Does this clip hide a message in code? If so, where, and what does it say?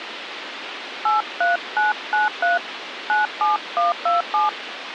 Yes: DTMF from 1.1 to 4.5 s, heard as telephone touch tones, dialled by hand, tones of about 150 ms, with radio hiss and a squelch burst at the end. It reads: 83993 97127